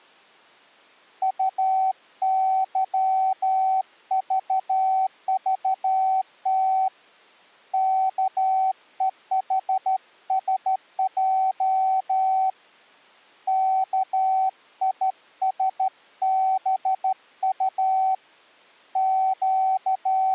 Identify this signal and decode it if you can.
Morse code, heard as a keyed tone, hand-sent with a straight key, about 13 wpm, 760 Hz. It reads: UYVVT KEHSJ KISBU …